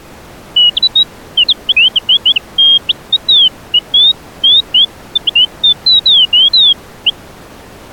Bird-like chirps. There is no code.